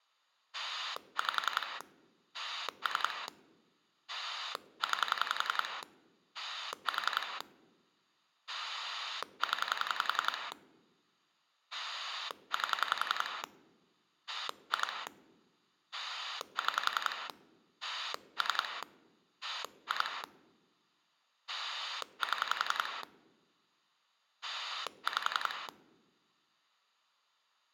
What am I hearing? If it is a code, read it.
Pulse dialling, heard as a rotary dial, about 11 pulses a second. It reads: 5 3 9 4 0 8 2 6 3 2 7 5